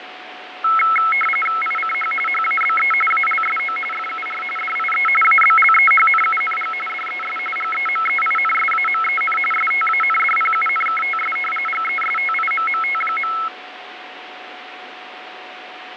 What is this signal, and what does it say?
RTTY (45.45 baud, 850 Hz shift), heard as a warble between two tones, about 1750 Hz centre, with radio static, fading and a steady whistle near 740 Hz. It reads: ICH HABE ALSO FUR DIE ABLEHNUNG DES GEMEINSAMEN STANDPUNKTS GESTIMMT.